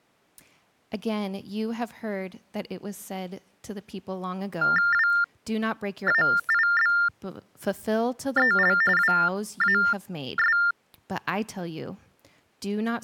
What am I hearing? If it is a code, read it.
TTY/TDD text telephone tones (45.45 baud Baudot), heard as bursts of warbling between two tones, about 400 Hz shift, 1600 Hz centre, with speech in English. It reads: WAIBEL WAS